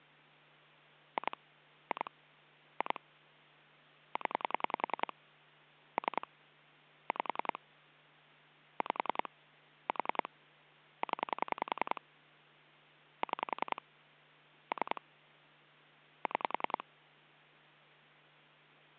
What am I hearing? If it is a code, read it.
Pulse dialling, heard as clicks on a phone line, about 10 pulses a second, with hum. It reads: 2 2 2 0 3 5 5 4 0 6 3 6